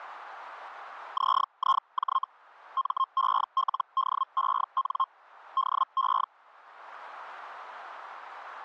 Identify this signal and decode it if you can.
Hellschreiber (Feld-Hell, 122.5 baud), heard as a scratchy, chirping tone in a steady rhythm, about 1060 Hz. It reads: ZIJ MELDEN DE